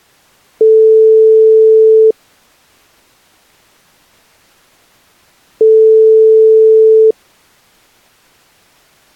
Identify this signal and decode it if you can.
Telephone call progress tone (single-tone plan, as in most of Europe), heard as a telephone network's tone, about 440 Hz, 1.5 s on and 3.5 s off. Ringback tone.